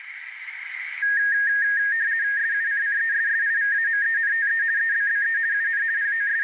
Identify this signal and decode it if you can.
RTTY (50 baud, 170 Hz shift), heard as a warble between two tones, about 1750 Hz centre, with radio static and room echo. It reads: SUCCESSIVAMENTE EBBE UN …